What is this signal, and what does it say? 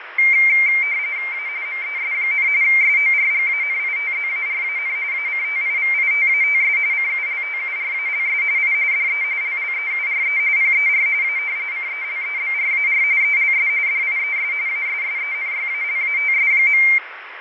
RTTY (45.45 baud, 170 Hz shift), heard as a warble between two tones, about 2200 Hz centre, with radio static and fading. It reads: A MES, SORGANITZARAN ACTIVITATS CULTURALS I DE LLEURE PER A CELEBRAR ELS DIES ASSENYALATS.